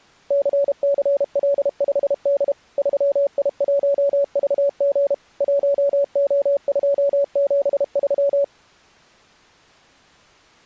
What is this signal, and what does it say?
Morse code, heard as a keyed tone, machine-sent, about 32 wpm, 560 Hz. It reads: CCL5D 3I1VG 1O273